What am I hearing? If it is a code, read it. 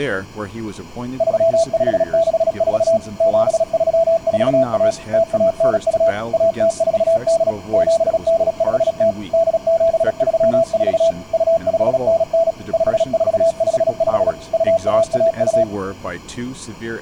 Morse code (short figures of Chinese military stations), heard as a keyed tone, machine-sent, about 36 wpm, 660 Hz, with speech in English. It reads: 3564 7341 0192 1048 7850 8734 2599 5455 2112